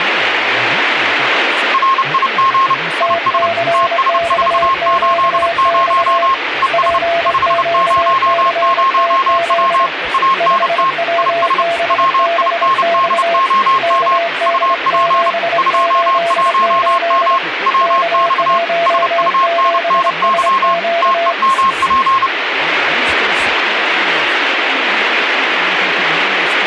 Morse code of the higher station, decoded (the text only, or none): RIG IS TS480 ES 500W ANT IS WINDOM UP 21M WX SUNNY TEMP